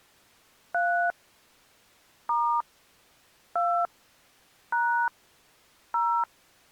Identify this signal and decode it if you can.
DTMF, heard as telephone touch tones, dialled by hand, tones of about 260 ms. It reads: 3 * 2 # 0